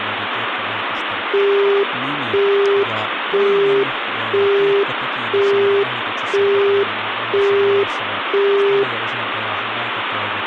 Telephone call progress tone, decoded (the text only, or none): busy tone